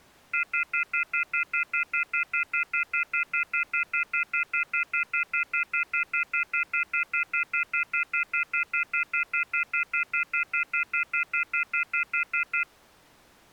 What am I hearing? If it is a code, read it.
Telephone call progress tone (North American plan), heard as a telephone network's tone, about 1400, 2050, 2450, 2600 Hz, 0.1 s on and 0.1 s off. Off-hook warning tone.